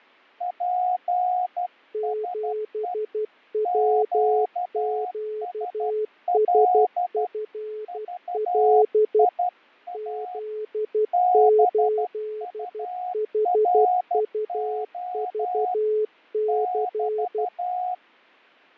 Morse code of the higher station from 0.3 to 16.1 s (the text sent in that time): PSE QSL VIA BURO